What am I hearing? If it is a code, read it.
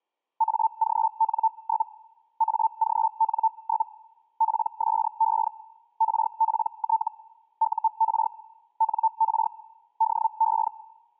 Hellschreiber (Feld-Hell, 122.5 baud), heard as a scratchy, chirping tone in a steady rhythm, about 890 Hz. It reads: AGN? AGN? PSE RPT UR NR DE